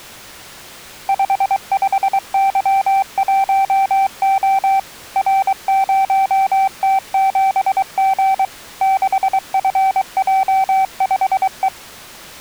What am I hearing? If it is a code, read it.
Morse code, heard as a keyed tone, machine-sent, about 23 wpm, 780 Hz. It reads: 55Y1O R0T7G 6FJ5E